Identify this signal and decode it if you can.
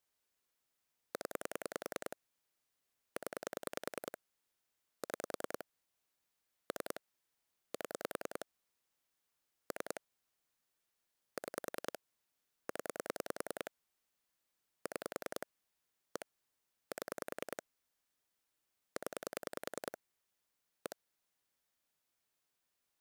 Pulse dialling, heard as clicks on a phone line, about 10 pulses a second. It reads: 0 0 6 3 7 3 6 0 6 1 7 0 1